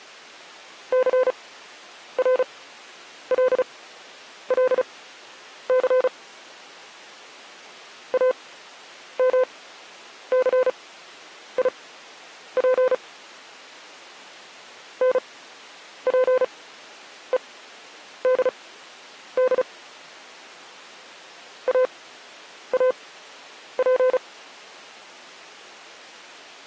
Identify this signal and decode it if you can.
Morse code (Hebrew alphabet), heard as a keyed tone, machine-sent, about 35 wpm, spaced as for 9 wpm, 510 Hz. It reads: סרללס אמסיף נפודד אאף